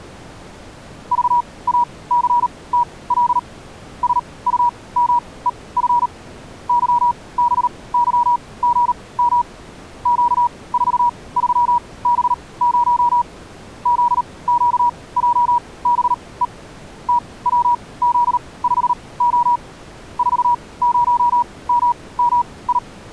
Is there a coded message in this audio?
Yes: Morse code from 1.1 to 22.8 s, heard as a keyed tone, machine-sent, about 38 wpm, spaced as for 22 wpm, 960 Hz. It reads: VACTL SUMEF YBYGM Q43B0 ZQJBE TWZ5O 40MMI